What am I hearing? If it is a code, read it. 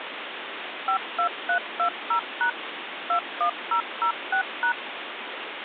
DTMF, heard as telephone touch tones, dialled by machine, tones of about 90 ms, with phone line noise. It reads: 52320# 21006#